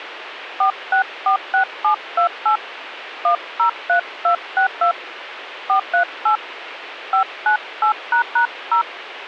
DTMF, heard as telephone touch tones, dialled by hand, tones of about 100 ms, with radio hiss and a squelch burst at the end. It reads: 4646728 103262 438 598##0